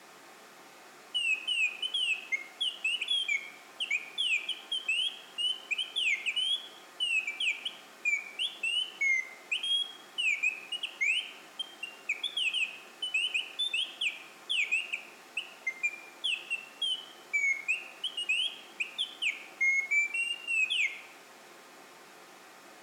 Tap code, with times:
none

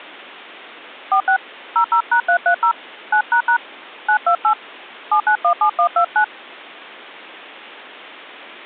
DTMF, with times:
1.1-1.4 46
1.8-2.7 00#330
3.1-3.6 9##
4.1-4.5 928
5.1-6.2 7917129

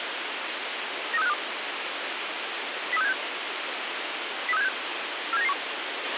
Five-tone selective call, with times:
1.1-1.3 93652
2.9-3.1 03676
4.5-4.7 03676
5.3-5.5 47991

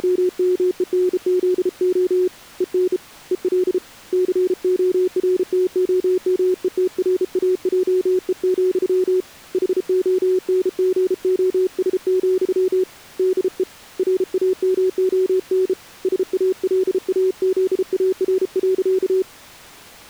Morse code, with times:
0.0-2.3 …
2.6-3.0 EN
3.3-3.8 EL
4.1-9.2 CORTOMETRAJE,
9.5-12.8 HONGOS,
13.2-13.6 DE
14.0-15.7 RAMON
16.0-19.2 SALAZAR.

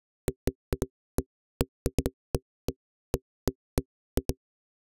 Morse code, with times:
none

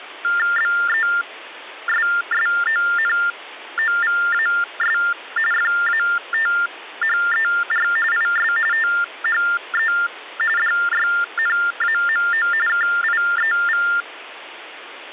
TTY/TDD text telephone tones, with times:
0.6-5.0 BESSONOVAS
5.5-7.9 FATHER
8.1-8.5 IS
8.7-9.9 THE
10.6-12.5 DYNAMO
12.7-13.9 KIEV

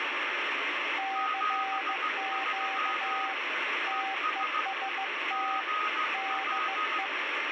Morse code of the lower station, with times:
1.0-3.3 CQ
3.9-5.6 TEST
6.1-7.1 DE

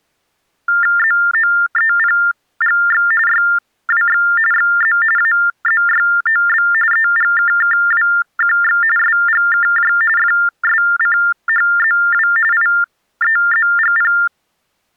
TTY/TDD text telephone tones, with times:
1.0-3.1 ZOEPGX
3.3-4.2 YWX
4.5-5.0 XZ
5.2-6.7 AZYOB
6.9-8.8 EGKKWQX
9.0-9.9 SGKJ
10.2-12.3 FSCHZW
12.5-14.1 IEZGP

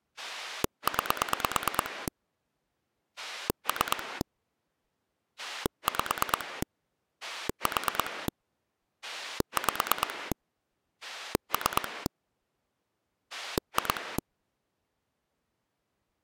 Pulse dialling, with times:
0.2-2.1 9
3.2-4.2 3
5.4-6.6 5
7.2-8.3 4
9.0-10.3 5
11.0-12.1 3
13.3-14.2 2

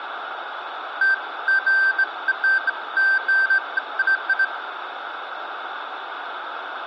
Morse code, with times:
none

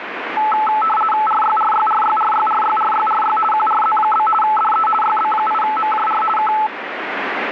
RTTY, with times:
1.3-3.4 RYRYRYRYRYRYRY
3.5-4.3 QRZ?
4.4-4.9 DE
5.0-6.2 YB8MJR
6.4-6.5 K

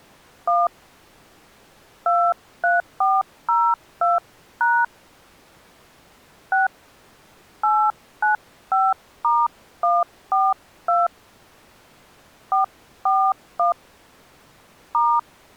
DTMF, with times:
0.5-0.7 1
2.1-4.8 23402#
6.5-6.7 6
7.6-11.1 895*142
12.5-13.7 441
14.9-15.2 *

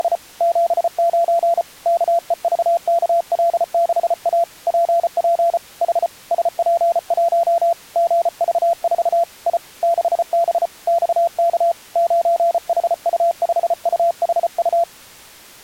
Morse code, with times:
0.0-0.2 …
0.4-1.6 79
1.9-4.4 KEVKL6A
4.7-5.6 PP
5.8-6.1 H
6.3-7.7 SP1
8.0-9.2 GV4
9.5-9.6 I
9.8-10.7 6B
10.9-11.7 XK
12.0-14.8 9HU5UHU

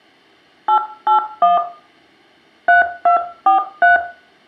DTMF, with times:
0.7-1.6 881
2.7-4.0 3243

